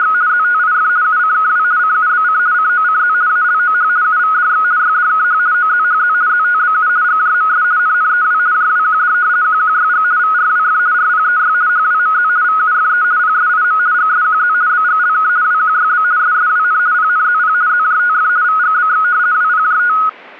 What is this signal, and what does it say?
RTTY (50 baud, 170 Hz shift), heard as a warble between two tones, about 1360 Hz centre. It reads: … ZTIF UCKW CUBC COCZ ALOH UVDX YDKH OZHZ ZTBU GJMS NNEW JWQD QQYG VRWF RPEY HWMZ VUFE PSIM GSQZ BGLK WQYB SSWN PNZP ZJTF VGBX WPJT